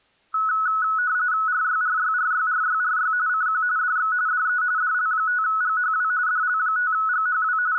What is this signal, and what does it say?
RTTY (45.45 baud, 170 Hz shift), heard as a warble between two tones, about 1380 Hz centre. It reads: RYRYRYRYRY CQ DX DE DL5GHW DL5GHW …